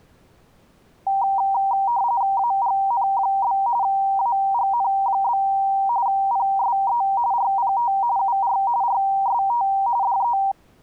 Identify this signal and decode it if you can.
RTTY (45.45 baud, 170 Hz shift), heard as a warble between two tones, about 870 Hz centre. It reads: AGN? AGN? PSE RPT UR RST DE